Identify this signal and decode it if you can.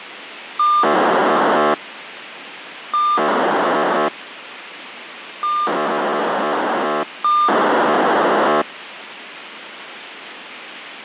POCSAG pager data (2400 baud), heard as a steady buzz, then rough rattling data, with radio hiss.